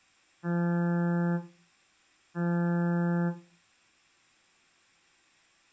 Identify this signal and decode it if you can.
Ship horn signal, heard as a ship's horn, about 170 Hz. 2 short. At sea: I am altering course to port.